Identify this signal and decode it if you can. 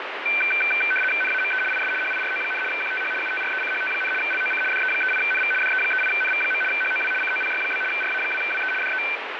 RTTY (75 baud, 850 Hz shift), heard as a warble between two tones, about 1950 Hz centre, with radio static. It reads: NAME IS HIRO, QTH UTRECHT, LOC DE38NV DE38NV. HOW COPY? RA2WE DE